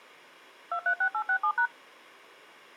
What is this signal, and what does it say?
DTMF, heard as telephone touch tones, dialled by machine, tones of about 80 ms. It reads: 236867#